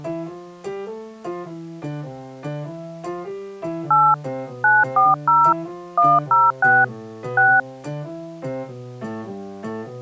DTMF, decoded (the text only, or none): 8 940 106 6